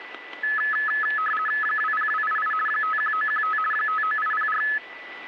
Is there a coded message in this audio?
Yes: RTTY (50 baud, 450 Hz shift) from 0.4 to 4.8 s, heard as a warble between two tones, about 1500 Hz centre, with a steady whistle near 1980 Hz. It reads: 20288 51915 59804